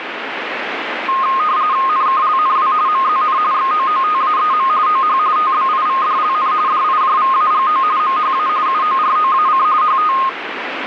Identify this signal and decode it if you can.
RTTY (45.45 baud, 170 Hz shift), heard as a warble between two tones, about 1150 Hz centre, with radio static. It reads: NKLNW MZN XOOTAEM OH TBIVDLN DIJVAGO MHA UOROAC HT